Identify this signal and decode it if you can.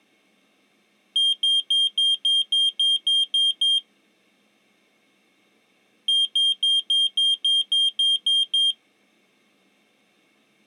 Beep code, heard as a piezo beeper, played twice, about 3200 Hz. 10 short. In AMI BIOS tables: CMOS shutdown register error.